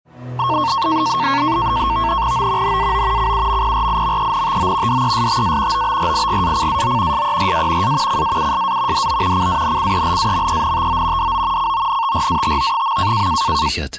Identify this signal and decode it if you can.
NAVTEX (SITOR-B), 100 baud, 170 Hz shift, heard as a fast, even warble, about 1000 Hz centre. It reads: O NAO CUMPRIMENTO DESTA OBRIGACAO SERA A CAUSA DO CANCELAMENTO DO CONTRATO.